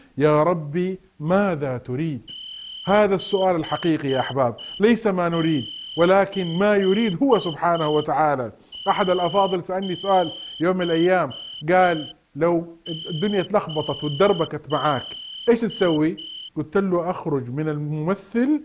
Morse code, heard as a whistle, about 5 wpm. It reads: 6678